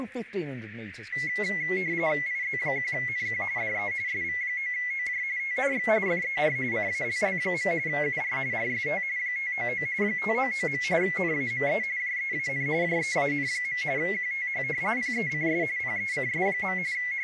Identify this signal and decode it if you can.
RTTY (45.45 baud, 170 Hz shift), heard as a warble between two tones, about 2050 Hz centre, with radio static and speech in English. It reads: IZ1NQ DE SV9OJ TNX FER CALL. UR RST 599 599. NAME JEAN JEAN. QTH PECS PECS. …